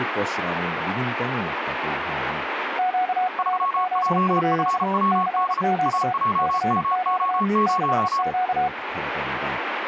Morse code, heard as two keyed tones, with radio static and speech in Korean. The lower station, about 32 wpm, 740 Hz: QRZ? CQ CQ CQ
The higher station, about 34 wpm, 1100 Hz: 3JFWD AJMO0